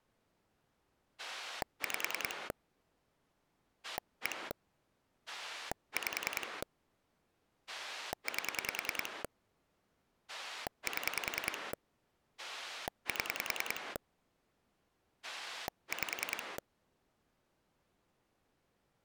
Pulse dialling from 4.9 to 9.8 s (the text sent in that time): 5 8